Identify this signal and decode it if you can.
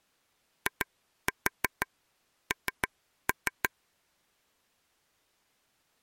Tap code, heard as taps on a table, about 6 knocks a second. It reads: IN